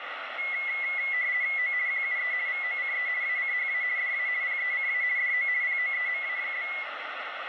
RTTY (50 baud, 170 Hz shift), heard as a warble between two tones, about 2050 Hz centre, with radio static. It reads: O QUE VOCE ACHA DA PECA DO POEMA?